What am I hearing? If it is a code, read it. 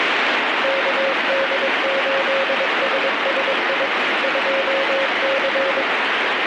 Morse code, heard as a keyed tone, machine-sent, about 22 wpm, 540 Hz, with heavy radio static. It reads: KD8SSI 2C